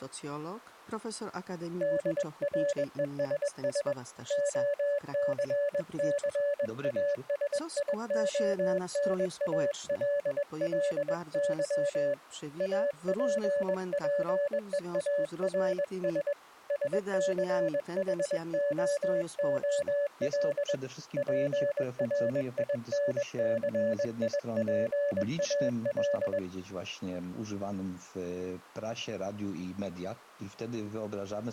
Morse code, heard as a keyed tone, hand-sent with a paddle, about 21 wpm, 570 Hz. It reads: DRESS OCCASIONALLY APPEARS SCHOOL PRINCIPAL